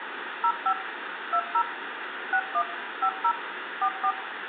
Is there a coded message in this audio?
Yes: DTMF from 0.4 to 4.1 s, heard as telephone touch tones, dialled by machine, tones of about 70 ms, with phone line noise and room echo. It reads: 05 20 61 50 44